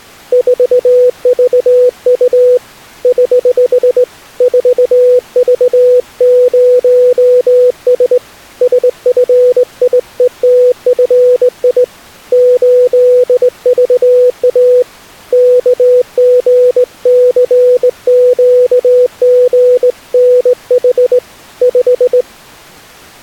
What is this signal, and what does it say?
Morse code, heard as a keyed tone, hand-sent with a straight key, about 19 wpm, 500 Hz. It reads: 4VU <HH> 4V0S SFIETFI 8VA KGCQGNH 5